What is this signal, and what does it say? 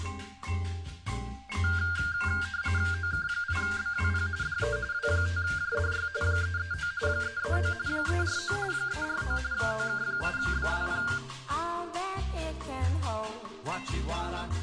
RTTY (45.45 baud, 170 Hz shift), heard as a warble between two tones, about 1500 Hz centre. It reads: OK8BWP DE W5JDY 339 339 349 349 OK8BWP